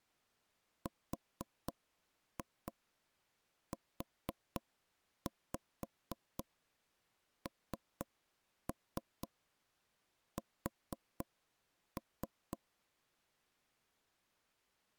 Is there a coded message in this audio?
Yes: tap code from 0.9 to 12.6 s, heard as knocks on wood, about 4 knocks a second. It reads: RUNS